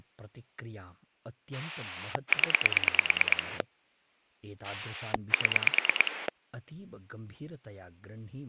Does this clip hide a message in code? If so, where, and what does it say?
Yes: pulse dialling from 1.5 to 6.3 s, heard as a rotary dial, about 9 pulses a second, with speech in Sanskrit. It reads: 0 7